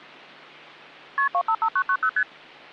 Multi-frequency trunk signalling (R1, as on North American trunks), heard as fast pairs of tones, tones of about 70 ms. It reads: KP 255990 ST